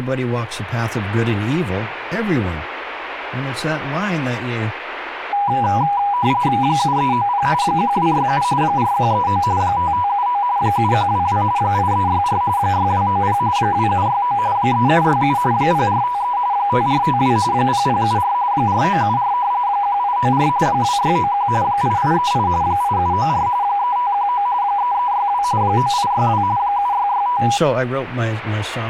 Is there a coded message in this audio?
Yes: RTTY (45.45 baud, 170 Hz shift) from 5.3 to 27.6 s, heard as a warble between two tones, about 900 Hz centre, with speech in English. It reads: 7390 1267 4139 5579 7122 8364 6290 2769 3767 0453 5452 0074 4974 1894 2691 8838 8794 3519 3362 9862 7665